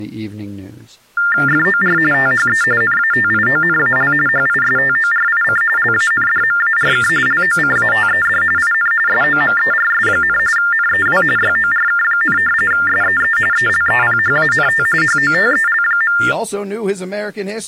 TTY/TDD text telephone tones (45.45 baud Baudot), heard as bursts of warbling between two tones, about 400 Hz shift, 1600 Hz centre, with speech in English. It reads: FOR THE NATIONAL HISTORIC LANDMARK LOCATED IN SOMERS, NEW YORK, SEE ELEPHANT HOTEL.